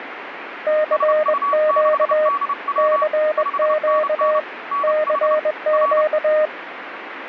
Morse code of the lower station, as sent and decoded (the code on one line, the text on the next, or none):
-.-. --.- / -.-. --.- / -.-. --.-
CQ CQ CQ